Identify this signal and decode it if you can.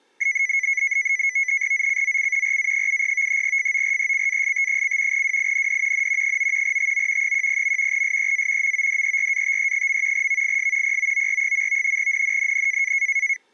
NAVTEX (SITOR-B), 100 baud, 170 Hz shift, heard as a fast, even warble, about 2100 Hz centre. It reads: ZCZC RA70 FORECAST: WIND N 9 TO 10. SEA MODERATE. VIS POOR. NNNN